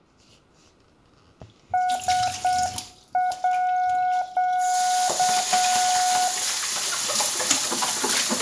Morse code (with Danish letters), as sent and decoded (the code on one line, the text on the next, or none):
... .--.-
SÅ